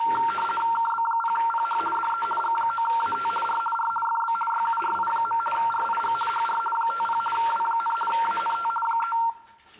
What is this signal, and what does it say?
RTTY (50 baud, 450 Hz shift), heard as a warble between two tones, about 1140 Hz centre, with the noise of a restroom. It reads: KB0PH DE G9AT R R FB YURI. RIG HR 50 W, ANT 3